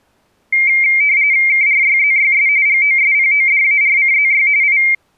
RTTY (45.45 baud, 170 Hz shift), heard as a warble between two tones, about 2200 Hz centre. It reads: KRYZYS GOSPODARCZY I